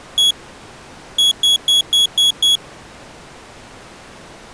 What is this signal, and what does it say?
Beep code, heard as a piezo beeper, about 3350 Hz. 1-6.